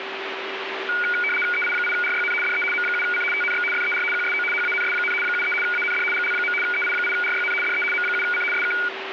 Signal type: RTTY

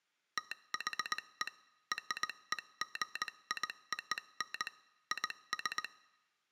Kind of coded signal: Morse code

